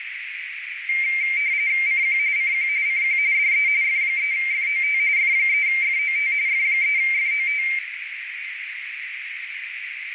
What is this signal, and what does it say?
RTTY (45.45 baud, 170 Hz shift), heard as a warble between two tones, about 2200 Hz centre, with radio static and a narrow filter. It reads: CQ CQ CQ DE F3FOT F3FOT F3FOT